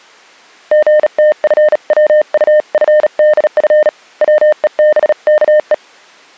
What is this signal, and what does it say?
Morse code (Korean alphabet), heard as a keyed tone, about 37 wpm, 610 Hz. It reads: 선비는 받아